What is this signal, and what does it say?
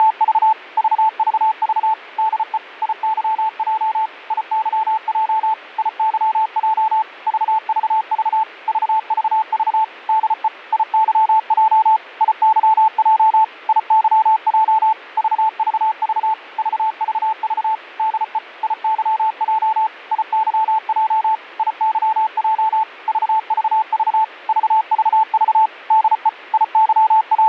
Morse code, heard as a keyed tone, machine-sent, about 34 wpm, 880 Hz. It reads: … VVV DE IYJ IYJ IYJ VVV VVV DE IYJ IYJ IYJ VVV VVV DE IYJ IYJ IYJ VVV VVV DE …